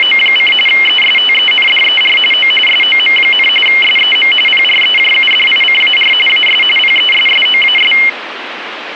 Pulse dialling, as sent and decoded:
none

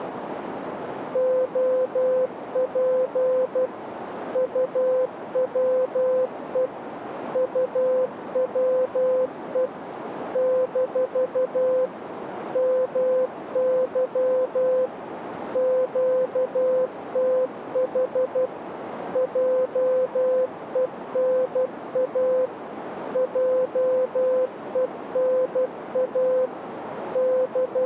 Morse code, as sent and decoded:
--- .--. / ..- .-- . / ..- .-- . / -....- / -- -.-- / --.- - .... / .--- . -. .- / .--- . -. .- / …
OP UWE UWE - MY QTH JENA JENA …

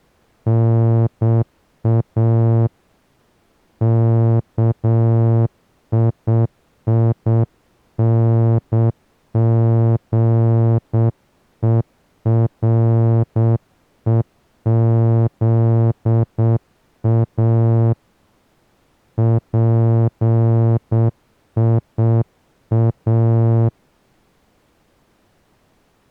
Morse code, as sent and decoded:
-. .- / -.- .. .. -. --. . .-. . --.. .- / .--. .. .-
NA KIINGEREZA PIA

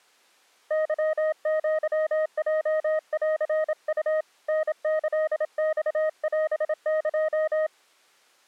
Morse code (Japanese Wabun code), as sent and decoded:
-.-- --.-- .--- .-.-. ..- / -. -.-.. -..- .-... -.---
ケアヲンウ タキマオエ

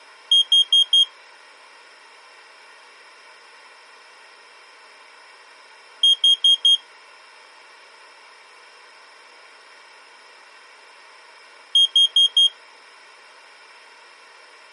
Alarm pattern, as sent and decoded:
4 beeps and a pause
temporal four

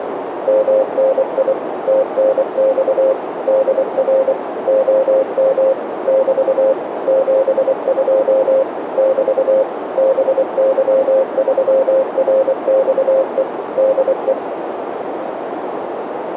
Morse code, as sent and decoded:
-- -. .. / - -. -..- / -.. .-. / --- -- / -...- / --... ..--- / -...- / -... -.-- ...-- .-. -..- . / -.. .
MNI TNX DR OM <BT> 72 <BT> BY3RXE DE

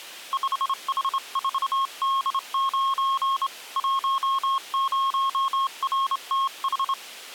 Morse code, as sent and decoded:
..... .... ....- -.. ----. / .---- ----- .-. - ....
5H4D9 10RTH

